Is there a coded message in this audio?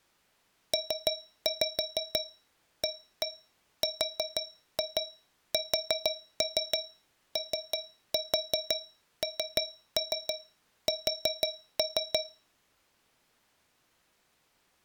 Yes: tap code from 0.7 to 12.5 s, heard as taps on a metal pipe, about 6 knocks a second. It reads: PARSONS